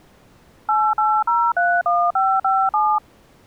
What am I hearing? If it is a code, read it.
DTMF, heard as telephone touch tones, dialled by machine, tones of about 250 ms. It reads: 88031557